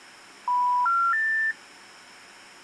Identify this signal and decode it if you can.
Telephone call progress tone (North American plan), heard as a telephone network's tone, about 980, 1370, 1800 Hz. Special information tone.